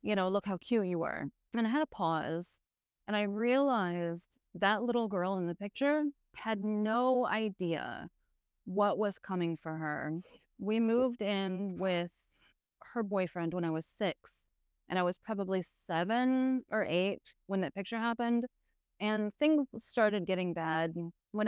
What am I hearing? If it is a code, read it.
Speech in English. There is no code.